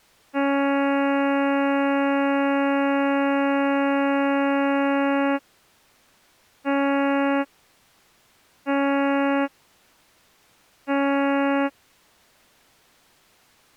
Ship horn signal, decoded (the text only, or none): 1 long, 3 short